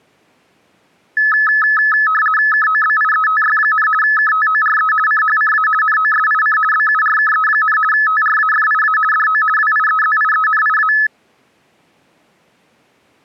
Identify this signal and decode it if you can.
RTTY (50 baud, 450 Hz shift), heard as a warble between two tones, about 1500 Hz centre. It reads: KOBIETY, KTORE CHCA NOSIC BURKE, TRAFIA DO WIEZIENIA